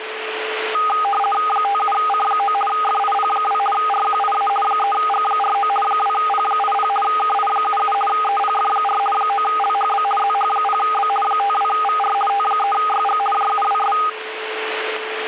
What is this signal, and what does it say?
RTTY (50 baud, 450 Hz shift), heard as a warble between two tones, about 1030 Hz centre, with radio static and a steady whistle near 440 Hz. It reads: 57C9 FIP2 RQIA 3G49 2P80 KI77 EPF4 9LHB ZH0B 52VR T3YG JUWS